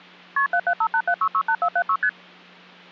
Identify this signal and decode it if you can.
Multi-frequency trunk signalling (R1, as on North American trunks), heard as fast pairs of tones, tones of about 70 ms. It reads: KP 77587668476 ST